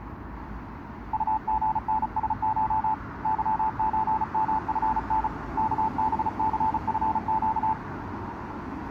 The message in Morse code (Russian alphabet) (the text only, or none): УГНСШ ЫЧМФН КБЦФЩ